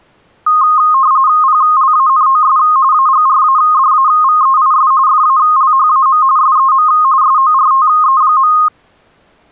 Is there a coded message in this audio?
Yes: RTTY (45.45 baud, 170 Hz shift) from 0.5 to 8.7 s, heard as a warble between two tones, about 1160 Hz centre. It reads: PLANOS AGRADAVEIS FALHAM SEM SORTE.